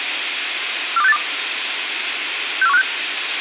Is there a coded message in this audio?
Yes: five-tone selective call (EEA) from 1.0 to 2.8 s, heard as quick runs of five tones, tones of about 40 ms, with radio hiss and a squelch burst at the end. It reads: 42682 64156